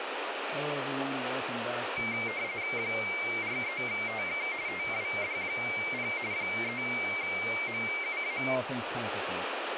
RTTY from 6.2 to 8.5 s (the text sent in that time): 3MUA